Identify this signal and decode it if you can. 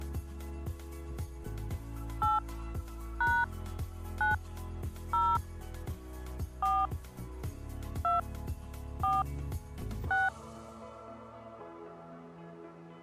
DTMF, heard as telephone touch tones, dialled by hand, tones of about 190 ms. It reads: 8 # 9 0 4 2 4 6